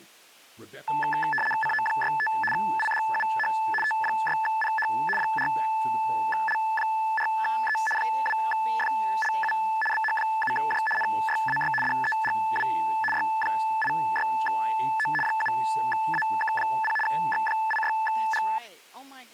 RTTY (75 baud, 850 Hz shift), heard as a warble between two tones, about 1300 Hz centre, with speech in English. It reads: CO65 IDUH T6PH 4L4E 2FLU BH7J NYAY DEGW Y86O 7AK0 X86G